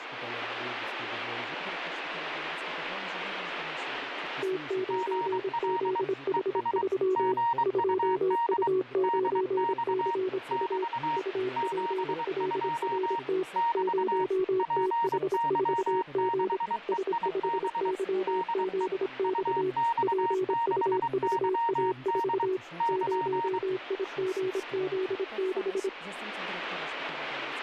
Morse code, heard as two keyed tones, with radio static. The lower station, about 26 wpm, 370 Hz: T9ZH3 2U9CU UPLRT 0TH4G S5YZX PUVA4 0IGZ6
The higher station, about 23 wpm, 930 Hz: GL ES GUD DX <BT> 72 <BT> PY6EIB DE UX6YD <KN>